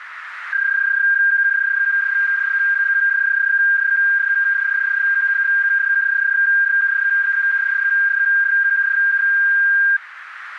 PSK31 (31.25 baud), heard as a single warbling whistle, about 1600 Hz, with radio static and a narrow filter.